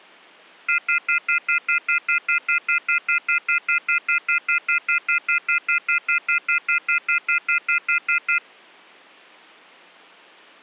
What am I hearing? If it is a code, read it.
Telephone call progress tone (North American plan), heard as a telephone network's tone, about 1400, 2050, 2450, 2600 Hz, 0.1 s on and 0.1 s off. Off-hook warning tone.